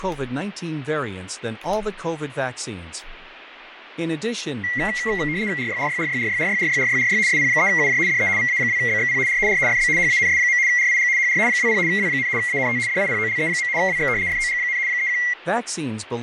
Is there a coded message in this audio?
Yes: RTTY (75 baud, 170 Hz shift) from 4.6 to 15.3 s, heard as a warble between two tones, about 2050 Hz centre, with radio static, fading and speech in English. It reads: RYRYRYRYRYRYRYRY SP3UJ DE VA2BXP R R FB HANS. RIG HR 20 W, ANT DIPOLE. WX FOG, 31